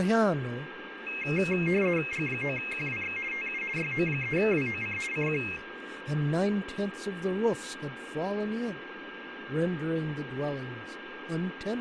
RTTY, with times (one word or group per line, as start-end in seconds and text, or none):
2.1-3.2 G9QWX
3.3-3.6 TU
3.8-5.0 YO3WOC
5.1-5.4 CQ